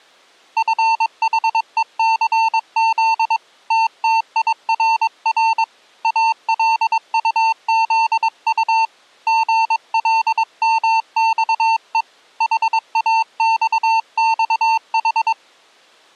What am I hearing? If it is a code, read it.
Morse code, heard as a keyed tone, hand-sent with a paddle, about 22 wpm, 900 Hz. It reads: FHECZ TTIRR ALUZU GLMXE HAXXH